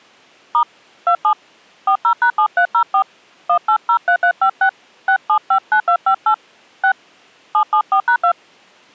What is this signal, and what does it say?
DTMF, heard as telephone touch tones, dialled by hand, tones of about 80 ms. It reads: * 27 40#7304 1803356 6759258 6 774#2